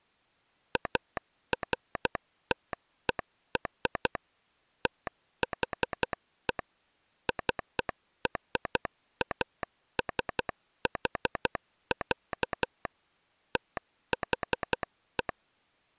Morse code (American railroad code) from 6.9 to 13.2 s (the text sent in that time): CRASH,